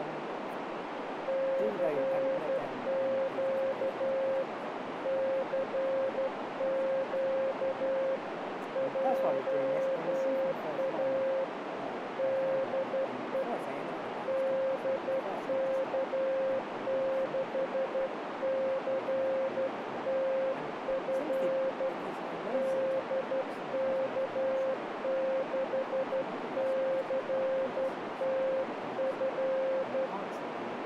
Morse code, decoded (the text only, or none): CQ CQ JA DE DK6CTF DK6CTF